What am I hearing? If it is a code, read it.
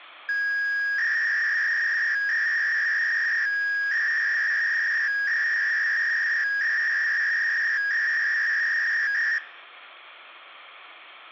300-baud modem data (V.21 tones), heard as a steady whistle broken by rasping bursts, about 300 baud, 200 Hz shift.